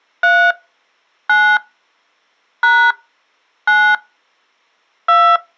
DTMF, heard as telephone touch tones, dialled by hand, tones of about 280 ms. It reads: 3 9 # 9 2